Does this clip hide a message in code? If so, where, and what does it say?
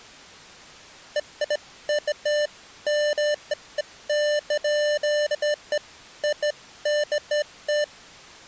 No, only beeps of irregular length.